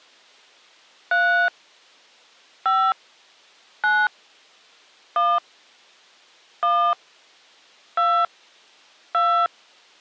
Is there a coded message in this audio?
Yes: DTMF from 1.1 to 9.5 s, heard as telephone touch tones, dialled by hand, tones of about 280 ms. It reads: 3 5 9 1 1 2 2